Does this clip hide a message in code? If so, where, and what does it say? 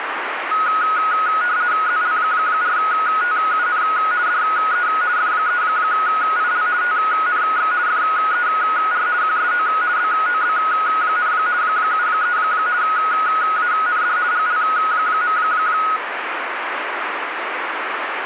Yes: RTTY (50 baud, 170 Hz shift) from 0.5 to 16.0 s, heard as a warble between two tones, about 1360 Hz centre, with radio static. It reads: ZL4TUN DE F3IL TNX FER QSO BOB, 73 AND GL.